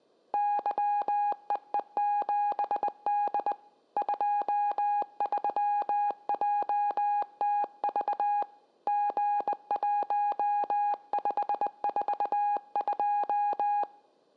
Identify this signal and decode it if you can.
Morse code, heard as a keyed tone, hand-sent with a bug key, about 20 wpm, 820 Hz, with room echo. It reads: YEE7D 23JTV G1542